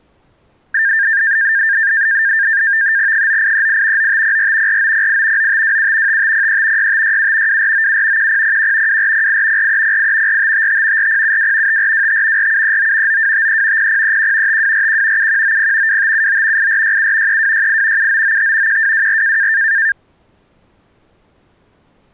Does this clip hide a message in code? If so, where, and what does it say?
Yes: NAVTEX (SITOR-B), 100 baud, 170 Hz shift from 0.7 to 19.9 s, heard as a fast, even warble, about 1700 Hz centre. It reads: 9838 9504 4908 9527 5503 6567 2497 1001 2408 4308 4555 4072 5425 4739 9253 0031 5241 7190 2579 8467 3268 7995 1224